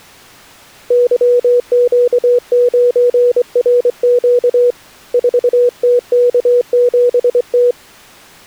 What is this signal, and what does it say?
Morse code, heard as a keyed tone, hand-sent with a straight key, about 24 wpm, 490 Hz. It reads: YQ9RQ 4TK7T